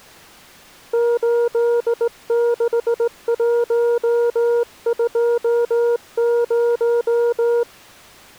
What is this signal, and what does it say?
Morse code, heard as a keyed tone, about 18 wpm, 470 Hz. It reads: 86120